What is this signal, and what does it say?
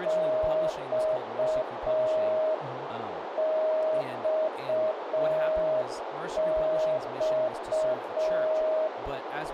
Morse code, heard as a keyed tone, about 5 wpm, 630 Hz, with radio static, a narrow filter and speech in English. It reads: XXX